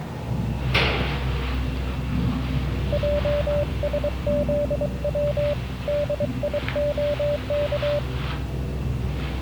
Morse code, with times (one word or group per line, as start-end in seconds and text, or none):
2.9-5.5 JSZW
5.9-8.0 DIOK